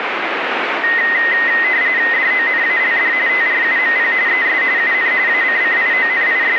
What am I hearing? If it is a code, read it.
RTTY (45.45 baud, 170 Hz shift), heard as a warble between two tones, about 1950 Hz centre, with radio static. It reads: DONALD TRUMP ES UN …